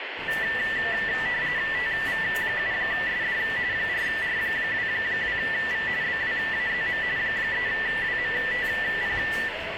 RTTY (45.45 baud, 170 Hz shift), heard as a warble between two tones, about 1850 Hz centre, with radio static and the noise of a cafe. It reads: TV7SD 4R22V BWAZM 3WMTP